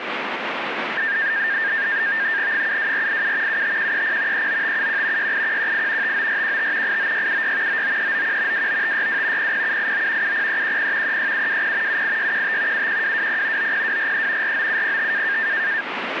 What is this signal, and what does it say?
NAVTEX (SITOR-B), 100 baud, 170 Hz shift, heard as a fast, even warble, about 1700 Hz centre, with radio static. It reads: 72487 75130 39571 68118 59415 89676 99391 29562 00789 70310 36720 78615 71220 90243 49705